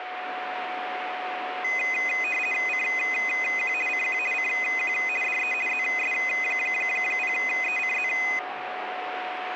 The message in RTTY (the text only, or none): CQ CQ CQ DE ZS0ECZ